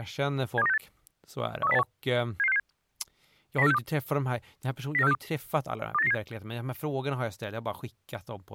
Five-tone selective call (EEA), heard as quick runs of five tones, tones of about 40 ms, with speech in Swedish. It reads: 72968 13081 77667 09462 09462 28997